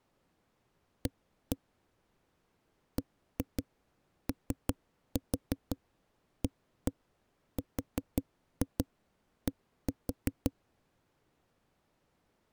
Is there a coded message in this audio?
Yes: tap code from 1.1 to 10.5 s, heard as knocks on a wall, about 5 knocks a second. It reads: A BOARD